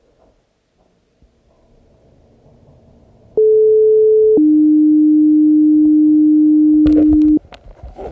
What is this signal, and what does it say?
Two-tone page, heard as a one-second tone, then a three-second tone, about 430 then 300 Hz, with the noise inside a lift.